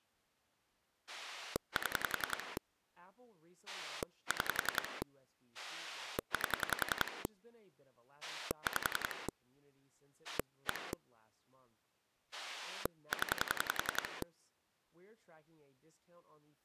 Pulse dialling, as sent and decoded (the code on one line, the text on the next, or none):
7 / 6 / 8 / 5 / 1 / 10
7 6 8 5 1 0